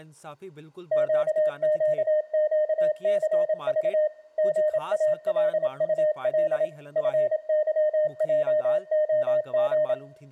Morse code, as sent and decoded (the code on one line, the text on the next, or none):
--.- --.- --.- -.-. ...- / --. .- .-.. ..- .-.. / ..-. -.-- .--- --- --.
QQQCV GALUL FYJOG